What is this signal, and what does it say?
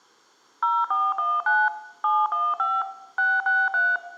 DTMF, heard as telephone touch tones, dialled by machine, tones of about 220 ms, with room echo. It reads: 0419 715 663